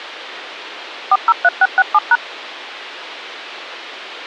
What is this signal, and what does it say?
DTMF, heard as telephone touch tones, dialled by machine, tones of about 40 ms. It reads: 403667#